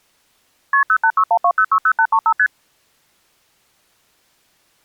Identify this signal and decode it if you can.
Multi-frequency trunk signalling (R1, as on North American trunks), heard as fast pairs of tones, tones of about 70 ms. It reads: KP 08612060835 ST